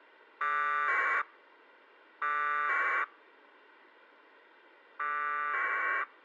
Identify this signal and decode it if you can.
Packet radio (AX.25, as in APRS), 1200 baud, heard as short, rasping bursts.